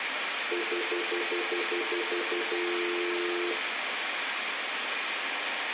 Telephone call progress tone (North American plan), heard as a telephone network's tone, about 350, 440 Hz, 0.1 s on and 0.1 s off, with phone line noise and room echo. Stutter dial tone.